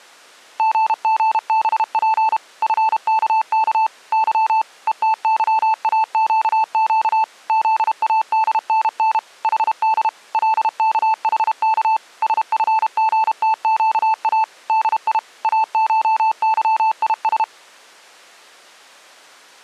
Morse code (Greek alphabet), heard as a keyed tone, machine-sent, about 32 wpm, 880 Hz. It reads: ΓΓΒΠ ΦΚΚ Υ ΕΤΥΑΨΨ ΖΑΔΝΝ ΗΔ ΛΚΗΚ ΣΦΓΤΨΑ ΔΙ ΑΧΥΙΣ